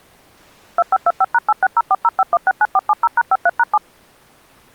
DTMF, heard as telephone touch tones, dialled by machine, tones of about 40 ms. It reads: 2525#860405169470#53#7